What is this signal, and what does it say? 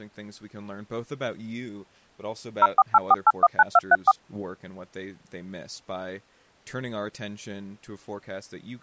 DTMF, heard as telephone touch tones, dialled by machine, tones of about 40 ms, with speech in English. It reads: 0484819234